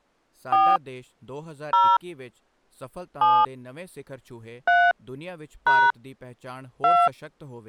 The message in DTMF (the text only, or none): 4 0 7 3 # 2